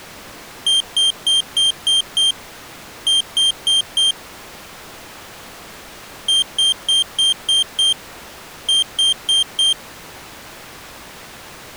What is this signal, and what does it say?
Beep code, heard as a piezo beeper, played twice, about 3150 Hz. 6-4.